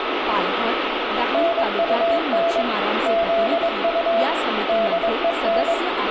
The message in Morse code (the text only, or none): NUN ZU DEN